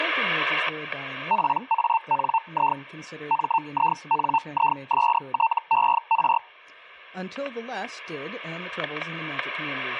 Hellschreiber (Feld-Hell, 122.5 baud), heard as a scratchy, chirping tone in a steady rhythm, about 900 Hz, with static crashes and speech in English. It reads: PANI MINISTER